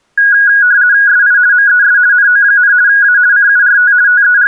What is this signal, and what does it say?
RTTY (50 baud, 170 Hz shift), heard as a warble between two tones, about 1550 Hz centre. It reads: SI MES NO, A CURT …